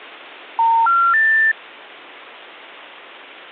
Telephone call progress tone (North American plan), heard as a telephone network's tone, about 910, 1370, 1800 Hz. Special information tone.